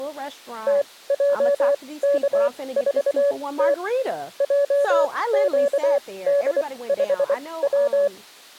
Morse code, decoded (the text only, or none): TJK4T JQD5W